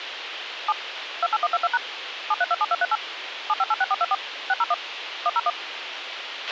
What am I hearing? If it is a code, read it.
DTMF, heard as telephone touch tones, dialled by machine, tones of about 40 ms, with radio hiss and a squelch burst at the end. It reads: 7 28122# 7327238 7586424 601 101